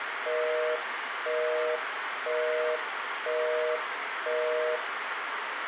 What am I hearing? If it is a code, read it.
Telephone call progress tone (North American plan), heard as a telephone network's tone, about 480, 620 Hz, 0.5 s on and 0.5 s off, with phone line noise and room echo. Busy tone.